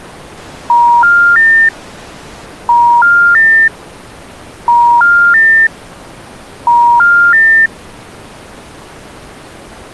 Telephone call progress tone (ITU plan), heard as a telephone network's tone, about 950, 1400, 1800 Hz. Special information tone.